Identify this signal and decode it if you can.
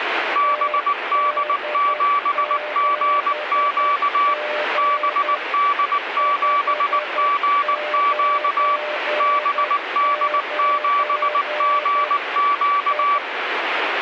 Morse code, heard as a keyed tone, machine-sent, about 19 wpm, 1150 Hz, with radio static and a weaker station near 600 Hz. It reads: BD7GQ BD7GQ BD7GQ